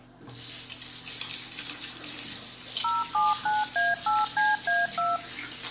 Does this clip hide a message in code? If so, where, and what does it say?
Yes: DTMF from 2.8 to 5.2 s, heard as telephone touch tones, dialled by machine, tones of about 190 ms, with the noise of a restroom. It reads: 079A8CA2